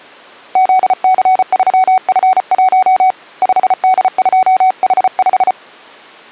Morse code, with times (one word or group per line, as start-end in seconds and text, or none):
0.6-3.1 ZC3F1
3.4-5.5 5D2H5